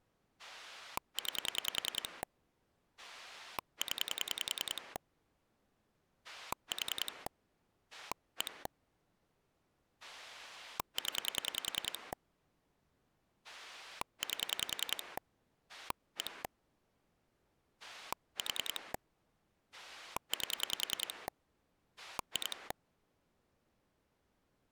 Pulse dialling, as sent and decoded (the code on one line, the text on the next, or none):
9 / 10 / 4 / 1 / 10 / 8 / 1 / 4 / 8 / 2
9 0 4 1 0 8 1 4 8 2